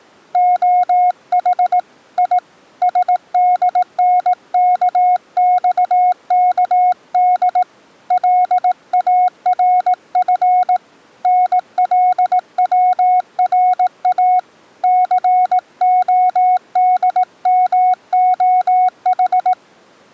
Morse code, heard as a keyed tone, hand-sent with a paddle, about 18 wpm, 730 Hz. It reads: OH I SDNKXKD LARF NLWRA CODMOH